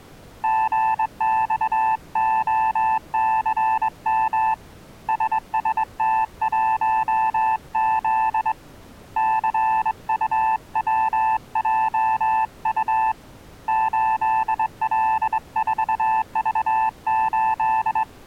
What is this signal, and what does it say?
Morse code, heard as a keyed tone, hand-sent with a straight key, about 22 wpm, 880 Hz. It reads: GXOCM SST1Z CUWJU 8L4V8